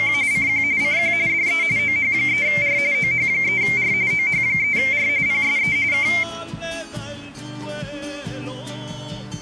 RTTY (45.45 baud, 170 Hz shift), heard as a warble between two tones, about 2200 Hz centre. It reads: … CQ CQ DE OH3R OH3R OH3R PSE K